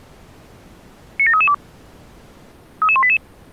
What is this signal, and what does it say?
Five-tone selective call (ZVEI), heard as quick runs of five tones, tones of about 70 ms. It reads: 97332 33188